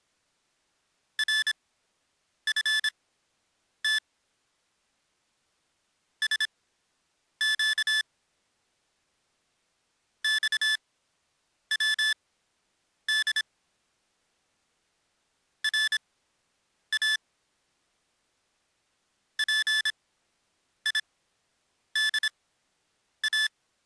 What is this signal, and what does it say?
Morse code (Persian alphabet), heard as electronic beeps, machine-sent, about 26 wpm, spaced as for 8 wpm, 1750 Hz. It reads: رفت سگ خود را پیدا